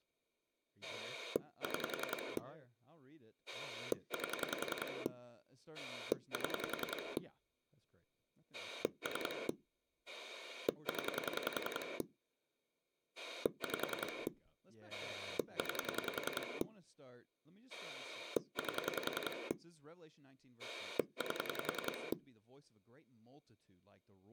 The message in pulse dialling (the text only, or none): 6 8 7 3 0 5 9 8 8